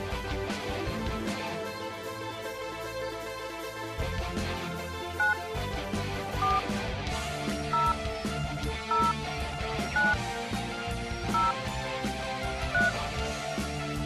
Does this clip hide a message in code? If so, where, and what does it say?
Yes: DTMF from 5.2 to 12.9 s, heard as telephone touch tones, dialled by hand, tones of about 170 ms. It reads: 9 4 0 0 9 0 3